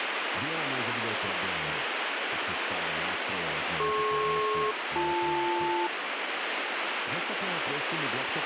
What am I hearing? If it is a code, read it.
Aircraft SELCAL, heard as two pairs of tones, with radio static and speech in Slovak. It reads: DP-BL